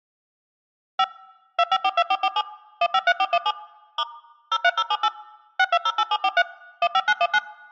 DTMF, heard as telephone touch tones, dialled by machine, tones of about 50 ms. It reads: 5 2542447 153417 * 03078 6208743 15919